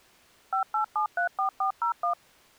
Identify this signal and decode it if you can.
DTMF, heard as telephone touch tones, dialled by machine, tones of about 100 ms. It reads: 58734401